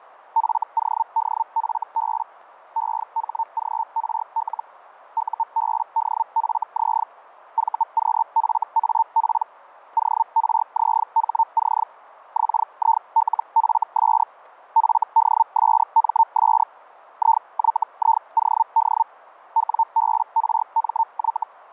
Hellschreiber (Feld-Hell, 122.5 baud), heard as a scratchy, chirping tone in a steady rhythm, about 900 Hz, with radio static and fading. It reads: FODFB EHGRL UBDFZ VQFAP ORZHC XILFS FDSMS IYIOD WBRMY